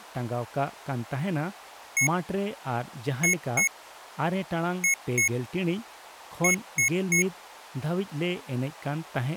Beep code, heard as beeps from a small speaker, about 2200 Hz, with speech in Santali. 1-2-2-3. In Phoenix BIOS tables: BIOS ROM checksum failure.